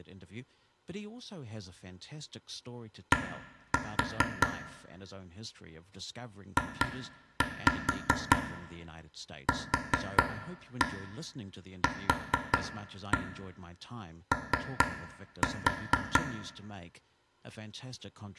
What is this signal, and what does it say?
Tap code, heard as taps on a table, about 4 knocks a second, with room echo and speech in English. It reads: D JQQO